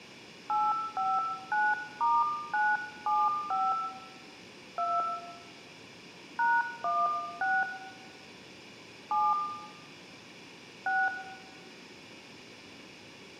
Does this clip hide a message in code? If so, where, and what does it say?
Yes: DTMF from 0.5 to 11.1 s, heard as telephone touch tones, dialled by hand, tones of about 220 ms, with room echo. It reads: 859*975 2 #16 7 6